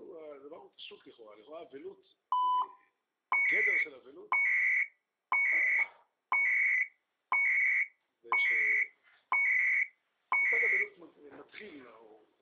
Radio time signal (CHU, Canada), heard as beeps and data bursts, one a second.